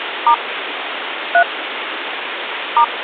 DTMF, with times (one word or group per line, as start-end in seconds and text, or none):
0.3-0.3 *
1.3-1.4 3
2.8-2.8 *